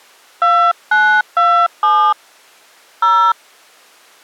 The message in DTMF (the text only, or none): 2927 0